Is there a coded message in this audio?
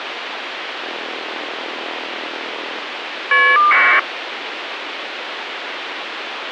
Yes: caller ID data burst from 0.8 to 4.0 s, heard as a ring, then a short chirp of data, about 1200 baud, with phone line noise.